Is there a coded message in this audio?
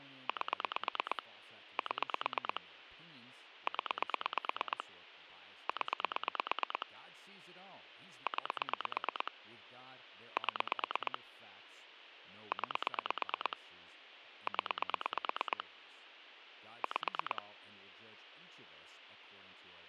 Yes: pulse dialling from 0.3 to 17.4 s, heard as clicks on a phone line, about 8 pulses a second, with phone line noise and speech in English. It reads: 8 7 0 0 9 7 9 0 5